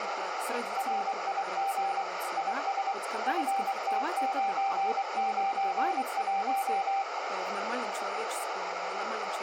Morse code, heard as a keyed tone, machine-sent, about 24 wpm, 780 Hz, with heavy radio static, a narrow filter and speech in Russian. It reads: RIG IS FT991